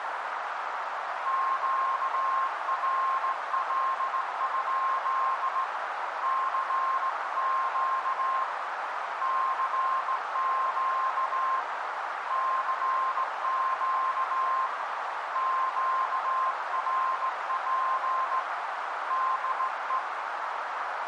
Morse code, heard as a keyed tone, hand-sent with a straight key, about 17 wpm, 1060 Hz, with heavy radio static and a narrow filter. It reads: QRL? CQ CQ CQ QRP DE